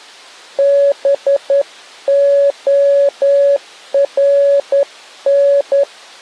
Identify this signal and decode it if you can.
Morse code, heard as a keyed tone, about 10 wpm, 560 Hz. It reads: BORN